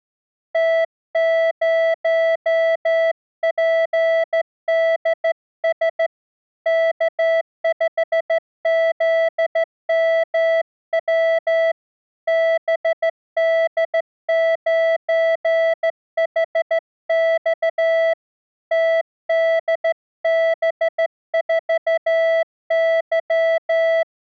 Morse code, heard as a keyed tone, hand-sent with a straight key, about 14 wpm, 660 Hz. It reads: T0PDS K5ZMW BD9HX TDB4Y